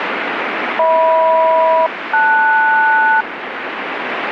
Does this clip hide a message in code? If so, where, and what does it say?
Yes: aircraft SELCAL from 0.8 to 3.2 s, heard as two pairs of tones, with radio static. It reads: HM-LS